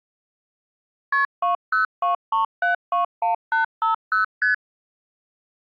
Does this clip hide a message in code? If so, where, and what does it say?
Yes: multi-frequency trunk signalling (R1, as on North American trunks) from 1.1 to 4.5 s, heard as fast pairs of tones, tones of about 130 ms. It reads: KP 2023721850 ST